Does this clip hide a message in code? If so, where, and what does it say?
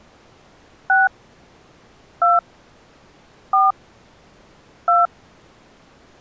Yes: DTMF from 0.9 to 5.1 s, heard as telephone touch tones, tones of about 180 ms. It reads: 6 2 4 2